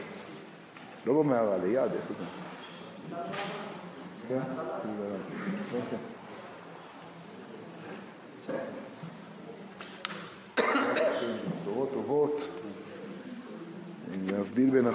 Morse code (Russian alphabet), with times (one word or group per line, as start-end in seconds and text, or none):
none